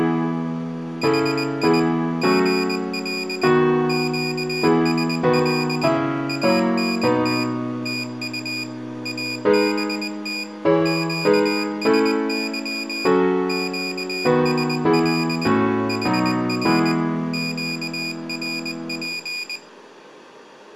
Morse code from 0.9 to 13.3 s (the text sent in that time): HI GL QSL ANT TU ABT QSY